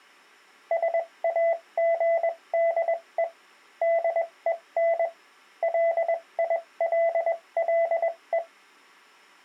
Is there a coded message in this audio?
Yes: Morse code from 0.7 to 8.4 s, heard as a keyed tone, machine-sent, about 21 wpm, spaced as for 18 wpm, 670 Hz. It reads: SAGDE DEN LILLE